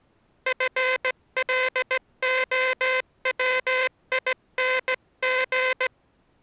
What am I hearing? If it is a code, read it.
Morse code, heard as a buzzer, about 17 wpm. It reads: FLOWING